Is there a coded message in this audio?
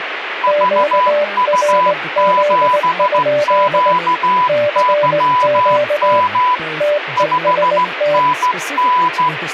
Yes: Morse code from 0.4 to 9.3 s, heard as two keyed tones, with radio static and speech in English. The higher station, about 15 wpm, 1000 Hz: VU7QYM 5NN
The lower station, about 19 wpm, 590 Hz: QRZ? CQ TEST